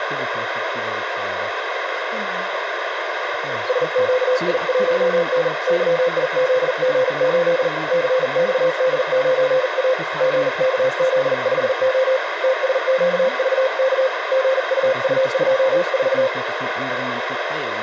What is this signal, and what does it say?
Morse code, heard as a keyed tone, hand-sent with a paddle, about 40 wpm, 520 Hz, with radio static and speech in German. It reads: SQI1N YIZG8 CXD9A GKZ5O TSQVK GUU24